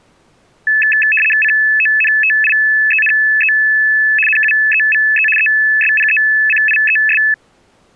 RTTY (75 baud, 850 Hz shift), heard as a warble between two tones, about 2150 Hz centre. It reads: CONTIENE NUEVE ESPECIES